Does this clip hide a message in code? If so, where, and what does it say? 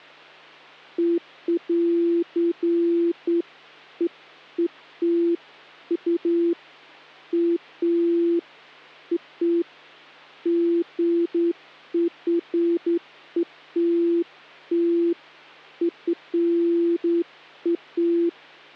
No, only beeps of irregular length, with hum.